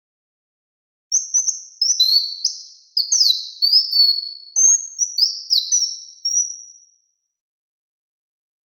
Bird-like chirps, with room echo. There is no code.